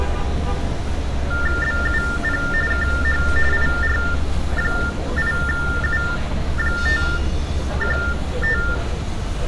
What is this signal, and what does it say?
TTY/TDD text telephone tones (45.45 baud Baudot), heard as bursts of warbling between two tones, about 400 Hz shift, 1600 Hz centre, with room echo and street noise. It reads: BUP KH IR8U515